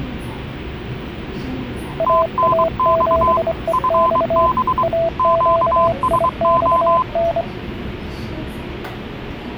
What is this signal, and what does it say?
Morse code, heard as two keyed tones, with the noise inside a subway train. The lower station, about 25 wpm, 660 Hz: AA7EX AQIXN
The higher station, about 23 wpm, 1020 Hz: TNX FB QSO